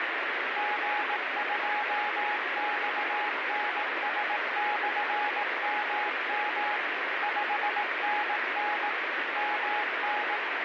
Morse code, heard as a keyed tone, machine-sent, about 18 wpm, 840 Hz, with heavy radio static. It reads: G2XNS/MM 5NN MN